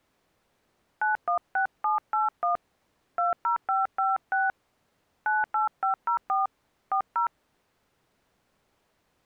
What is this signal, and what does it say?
DTMF, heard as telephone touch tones, dialled by hand, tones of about 140 ms. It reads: 916781 20556 98504 40